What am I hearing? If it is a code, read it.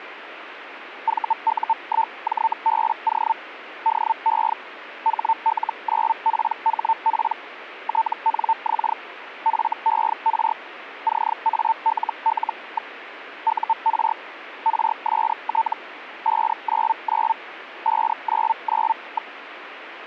Hellschreiber (Feld-Hell, 122.5 baud), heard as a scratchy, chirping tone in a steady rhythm, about 900 Hz, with radio static. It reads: VU1JBO DE HL9PHP TNX FER CALL. UR RST 599 599.